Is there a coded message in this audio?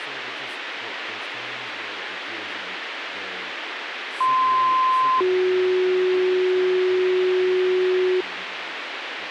Yes: two-tone page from 4.2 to 8.2 s, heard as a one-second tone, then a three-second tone, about 1040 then 370 Hz, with radio hiss, a squelch burst at the end and speech in English.